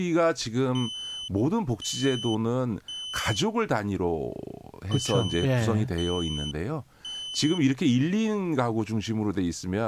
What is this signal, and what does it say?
Alarm pattern, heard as an alarm's beeps, played twice, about 3050 Hz, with speech in Korean. Temporal three. Smoke or fire, evacuate.